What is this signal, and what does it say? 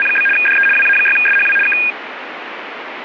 RTTY (75 baud, 850 Hz shift), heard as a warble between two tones, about 2050 Hz centre, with radio static. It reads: … DE WA6SHW K